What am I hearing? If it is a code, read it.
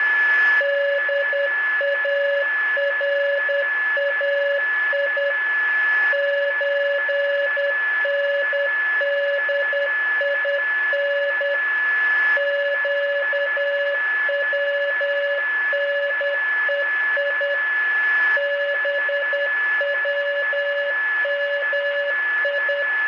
Morse code (Persian alphabet), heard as a keyed tone, machine-sent, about 10 wpm, 570 Hz, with a steady whistle near 1720 Hz and room echo. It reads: دارای چندین گونهی بومی